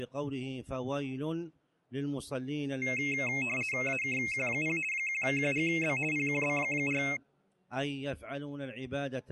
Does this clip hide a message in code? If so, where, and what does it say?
Yes: RTTY (50 baud, 450 Hz shift) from 2.8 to 7.2 s, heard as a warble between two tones, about 2350 Hz centre. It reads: AKQ0 1QGB PQB4